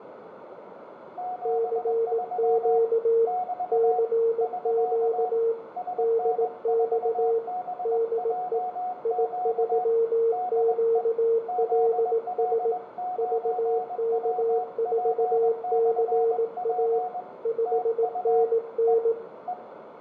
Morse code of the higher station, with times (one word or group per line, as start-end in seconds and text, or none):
1.2-2.8 73
3.3-4.0 <BT>
4.4-5.3 <SK>
5.8-9.8 SN4BJQ
10.3-11.0 DE
11.5-17.2 ZL9WP/P
17.7-18.4 TU
18.9-18.9 E
19.5-19.5 E